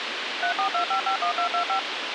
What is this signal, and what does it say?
DTMF, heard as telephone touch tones, dialled by machine, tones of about 100 ms, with radio hiss. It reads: 342551225